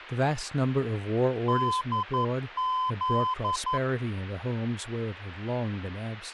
Morse code, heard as a keyed tone, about 11 wpm, 1020 Hz, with speech in English. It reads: DZ